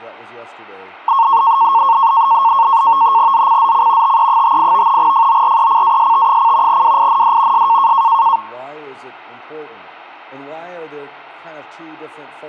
NAVTEX (SITOR-B), 100 baud, 170 Hz shift, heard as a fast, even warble, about 1000 Hz centre. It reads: ZCZC TE58 FORECAST: WIND S